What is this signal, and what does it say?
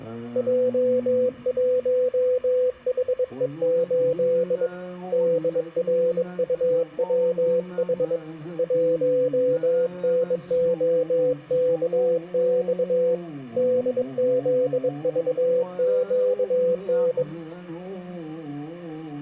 Morse code, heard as a keyed tone, hand-sent with a bug key, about 22 wpm, 500 Hz. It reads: J1HE8 DRUWH 1NOKX DZVQN